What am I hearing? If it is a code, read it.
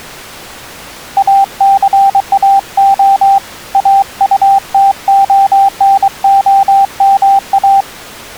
Morse code, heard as a keyed tone, hand-sent with a paddle, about 23 wpm, 790 Hz. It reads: ACAO AUTONOMA